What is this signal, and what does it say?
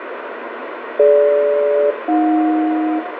Aircraft SELCAL, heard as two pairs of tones, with radio static and room echo. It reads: DG-AJ